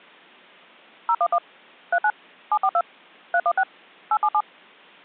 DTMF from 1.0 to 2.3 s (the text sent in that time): 011 39